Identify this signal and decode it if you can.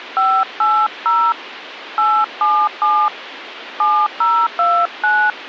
DTMF, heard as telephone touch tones, dialled by hand, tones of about 260 ms, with phone line noise. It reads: 580 877 7029